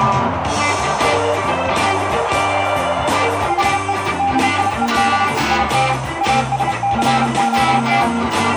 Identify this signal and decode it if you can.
Morse code, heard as a keyed tone, machine-sent, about 31 wpm, 800 Hz, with radio static and a narrow filter. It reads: HE DIED IN ASCOT